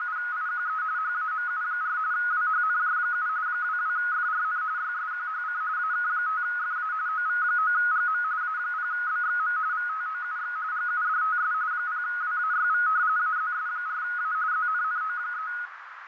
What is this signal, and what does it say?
RTTY (45.45 baud, 170 Hz shift), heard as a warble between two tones, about 1360 Hz centre, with radio static, fading and a narrow filter. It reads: … HAMU4 WHNJ7 22FRN YSQHC AK5FA OV9GM A0BXM VTOUX GUDTS 0WAYV AZS4A ZNNO3